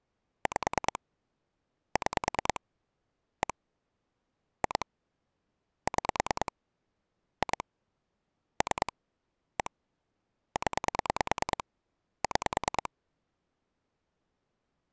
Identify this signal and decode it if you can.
Pulse dialling, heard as clicks on a phone line, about 9 pulses a second. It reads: 5 6 1 2 6 2 3 1 0 6